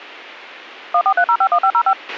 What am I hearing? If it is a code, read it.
DTMF, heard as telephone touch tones, dialled by machine, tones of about 70 ms, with a squelch burst at the end. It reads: 143051505